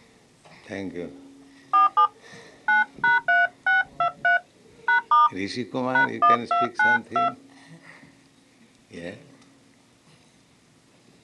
DTMF, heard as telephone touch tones, dialled by hand, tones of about 130 ms. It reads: 47 9#3623 #* #1292